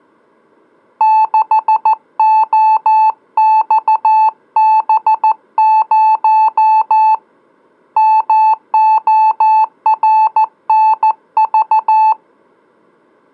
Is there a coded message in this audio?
Yes: Morse code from 0.9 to 12.2 s, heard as a keyed tone, hand-sent with a paddle, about 14 wpm, 870 Hz. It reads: 6OXB0 MORNV